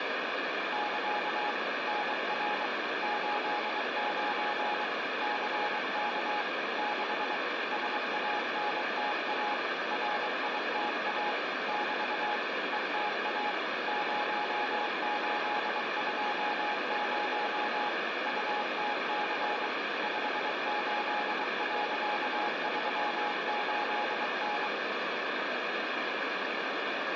Morse code, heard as a keyed tone, machine-sent, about 23 wpm, 840 Hz, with heavy radio static and room echo. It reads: <KA> NR 89 CK 6 SANTA RITA <BT> ETA 0820 UTC 58.38N